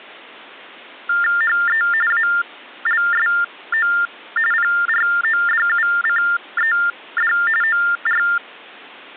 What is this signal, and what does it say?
TTY/TDD text telephone tones (45.45 baud Baudot), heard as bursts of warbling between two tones, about 400 Hz shift, 1600 Hz centre. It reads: HE ALSO PRODUCED OR